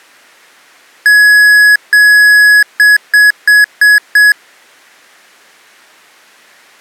Beep code, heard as beeps from a small speaker, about 1700 Hz. 2 long, 5 short.